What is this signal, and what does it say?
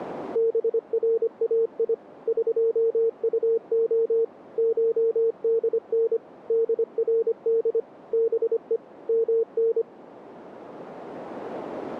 Morse code (Persian alphabet), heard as a keyed tone, machine-sent, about 25 wpm, 460 Hz. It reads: برای قطع شدن درد به من